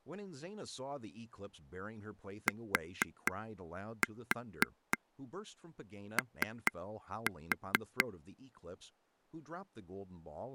Tap code, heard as taps on a table, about 4 knocks a second, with speech in English. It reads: TO